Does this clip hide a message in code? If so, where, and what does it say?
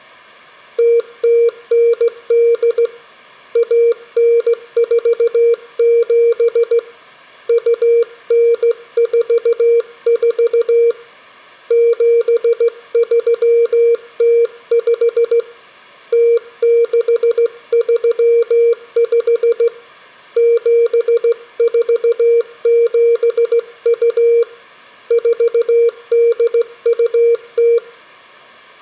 Yes: Morse code (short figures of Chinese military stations) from 0.7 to 27.8 s, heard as a keyed tone, hand-sent with a straight key, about 16 wpm, 470 Hz. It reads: 0098 1947 2944 7305 0635 7472 4820